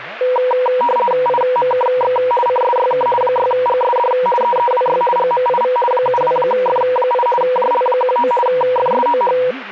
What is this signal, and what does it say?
RTTY (50 baud, 450 Hz shift), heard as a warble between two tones, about 730 Hz centre, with speech in Turkish. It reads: IMKX CSYK 6GSD EEWY GMIV 72F8 JL19 FSOH